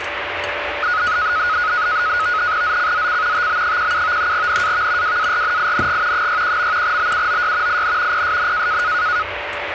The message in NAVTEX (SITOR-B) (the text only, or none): ZCZC TB17 NAV WARNING 61. BUOY IN PSN